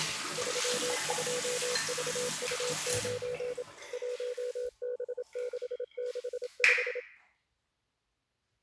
Morse code, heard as a keyed tone, machine-sent, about 27 wpm, 490 Hz, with the noise of a restroom. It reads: 32VU9 1B665